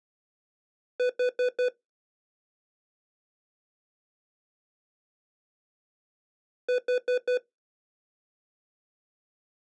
Alarm pattern, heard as an alarm's beeps, played twice, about 500 Hz. Temporal four. Carbon monoxide.